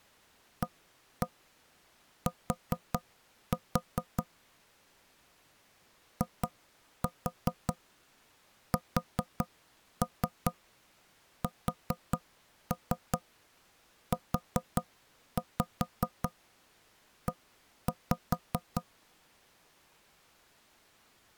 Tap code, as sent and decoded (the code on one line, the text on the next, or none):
1-1 4-4 / 2-4 4-3 4-3 4-5 1-5
AT ISSUE